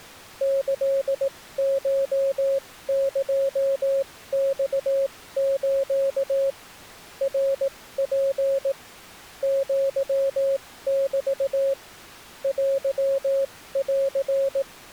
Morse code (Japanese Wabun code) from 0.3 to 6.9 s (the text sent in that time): キコエマス